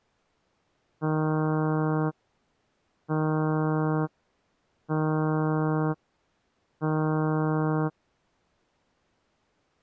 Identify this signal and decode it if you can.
Ship horn signal, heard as a ship's horn, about 160 Hz. 4 short. At sea: a pilot vessel's identity signal in fog.